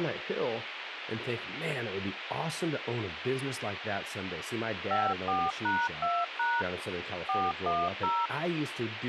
DTMF, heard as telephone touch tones, dialled by machine, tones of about 230 ms, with phone line noise and speech in English. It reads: 54#2# 410